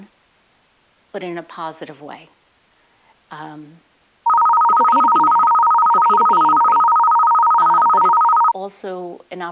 A tone that alternates evenly between two pitches, with speech in English. There is no code.